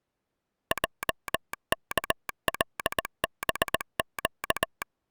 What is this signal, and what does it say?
Morse code, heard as a telegraph sounder, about 19 wpm. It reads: JKLBQ